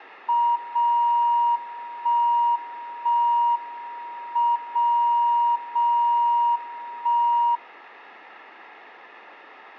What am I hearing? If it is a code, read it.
Radio time signal (WWVB), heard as a tone whose level steps once a second, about 950 Hz. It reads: 0 1 1 M 0 0 1